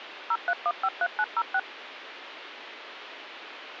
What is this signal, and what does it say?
DTMF, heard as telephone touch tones, dialled by machine, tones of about 50 ms, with phone line noise. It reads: 03153906